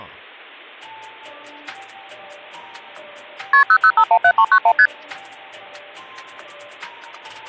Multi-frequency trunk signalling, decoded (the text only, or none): KP 00517391 ST